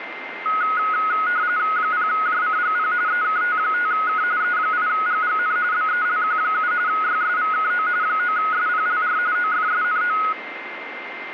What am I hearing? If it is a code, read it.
RTTY (45.45 baud, 170 Hz shift), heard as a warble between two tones, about 1360 Hz centre, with radio static and a steady whistle near 2090 Hz. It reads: 0JCGP EKT5K E8GGN BELQ7 YSVKO 9SPLR OFSNO